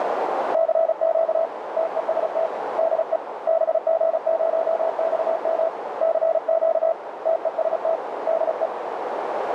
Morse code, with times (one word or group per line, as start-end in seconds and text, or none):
0.5-1.5 CQ
1.8-2.5 TEST
2.8-3.2 DE
3.5-5.7 BG0XM
6.0-6.9 CQ
7.3-8.0 TEST
8.3-8.7 DE